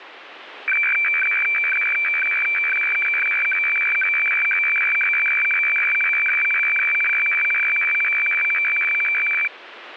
Weather fax (radiofax), 120 lines a minute, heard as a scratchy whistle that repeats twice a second, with radio static.